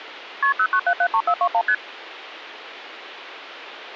Multi-frequency trunk signalling (R1, as on North American trunks), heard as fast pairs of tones, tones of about 70 ms, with phone line noise. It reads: KP 09773421 ST